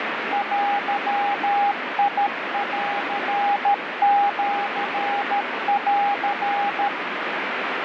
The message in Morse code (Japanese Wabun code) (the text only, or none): デンシン